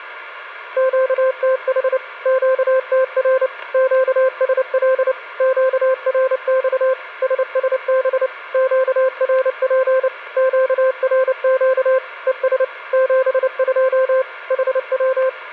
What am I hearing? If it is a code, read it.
Morse code, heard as a keyed tone, machine-sent, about 29 wpm, 520 Hz, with a steady whistle near 1410 Hz. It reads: QTH QTR QSL QRX SSB QRP QRQ ES 72 HW